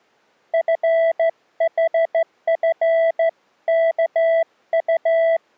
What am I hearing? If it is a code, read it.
Morse code (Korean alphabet), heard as a keyed tone, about 14 wpm, 660 Hz. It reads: 눈이